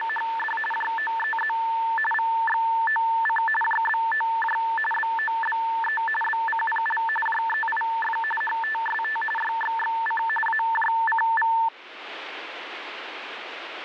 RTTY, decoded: … JOEZ VXOC JBOJ BOBE BCPL JEIF HTST YXXC AJCV

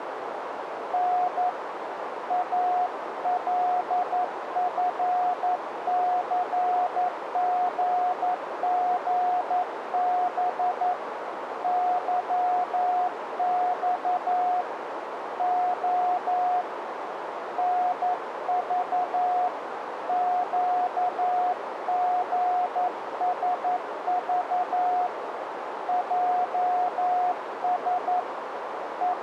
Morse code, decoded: N ALFCGGB YX O NV QGSV JS …

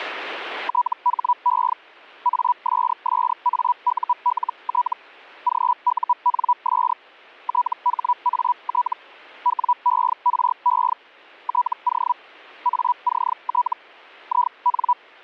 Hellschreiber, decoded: THE ASSAULT GUNS THAT WERE TO ACT IN

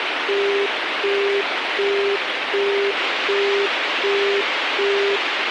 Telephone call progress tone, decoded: busy tone

